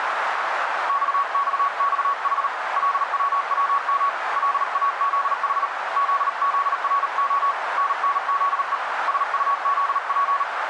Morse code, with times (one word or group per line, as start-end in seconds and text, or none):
0.9-2.5 XXXH
2.8-4.1 LWWM
4.4-5.7 LAZH
6.0-7.5 ZZRO
7.8-8.8 NNZE
9.1-10.4 SUZP